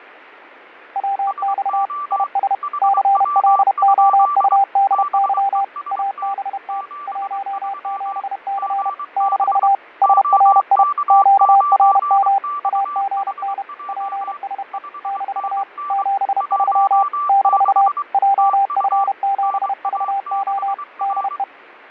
Morse code, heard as two keyed tones, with radio static and fading. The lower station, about 31 wpm, 790 Hz: WX IS CLOUDY ABT 17C - SRI QRM AGN PSE - 73 - JF7VO DE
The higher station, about 23 wpm, 1170 Hz: SO HW? BEST 73 GB OK9XHJ 5NN 16 TU NA6R